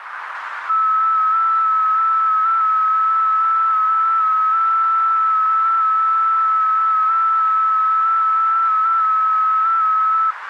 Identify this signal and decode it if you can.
FT8 (one signal), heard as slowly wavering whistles, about 6.25 baud, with radio static and a narrow filter.